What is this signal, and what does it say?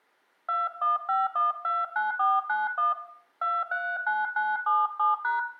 DTMF, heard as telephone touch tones, dialled by hand, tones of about 200 ms, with room echo. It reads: 215129491 239977#